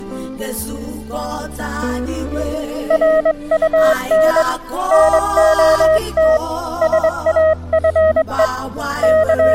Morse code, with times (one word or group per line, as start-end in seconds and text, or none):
2.9-4.4 RUN
4.9-6.4 NOT
6.8-8.5 SAFE
9.0-9.5 …